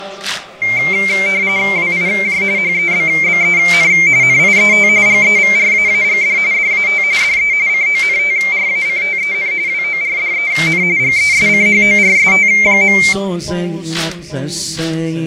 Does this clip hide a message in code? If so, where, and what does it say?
Yes: RTTY (45.45 baud, 170 Hz shift) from 0.6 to 13.1 s, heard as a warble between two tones, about 2200 Hz centre, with fading. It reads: WIJ HEBBEN NIET GEVRAAGD DAT DE CONTRACTEN WORDEN GESCHORST.